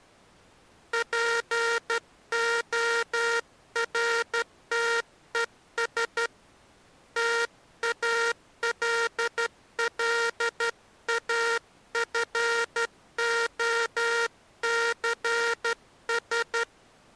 Morse code, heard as a buzzer, hand-sent with a straight key, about 12 wpm. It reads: PORTES TALLAFOCS